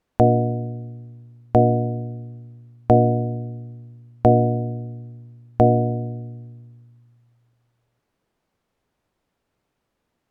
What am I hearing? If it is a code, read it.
Clock strike, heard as a bell. 5. Five o'clock.